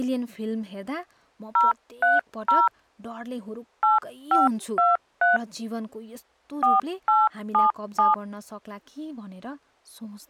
DTMF, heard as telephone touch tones, dialled by hand, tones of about 160 ms, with speech in Nepali. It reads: 030 8523 4877